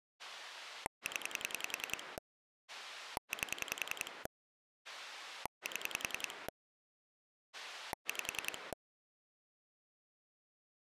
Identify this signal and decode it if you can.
Pulse dialling, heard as a rotary dial, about 10 pulses a second. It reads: 0 8 7 5